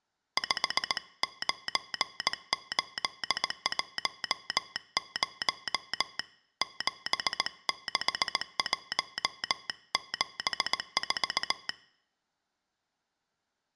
Morse code, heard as a telegraph sounder, hand-sent with a paddle, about 18 wpm. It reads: 59810 76174